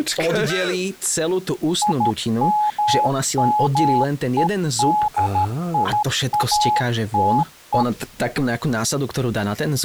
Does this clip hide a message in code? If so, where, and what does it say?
Yes: Morse code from 1.8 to 7.9 s, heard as a keyed tone, hand-sent with a paddle, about 13 wpm, 840 Hz, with speech in Slovak. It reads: IMMEDIATE